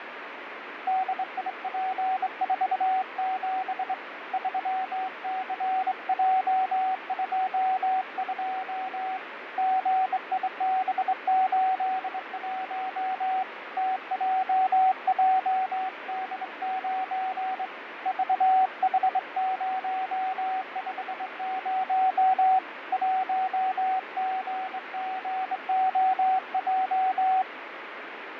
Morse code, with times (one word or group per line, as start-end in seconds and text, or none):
0.9-3.9 DIP47
4.3-9.2 3CJ22
9.6-13.4 GIB81
13.8-17.7 TJJD9
18.1-22.6 VH050
22.9-27.4 1GGOJ